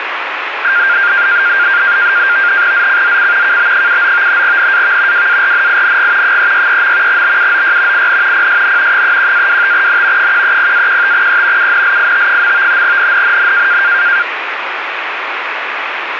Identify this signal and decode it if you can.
NAVTEX (SITOR-B), 100 baud, 170 Hz shift, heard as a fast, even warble, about 1500 Hz centre, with radio static. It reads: ZCZC KB79 NAV WARNING 363. BUOY IN PSN 31-25N 130-15E UNLIT. NNNN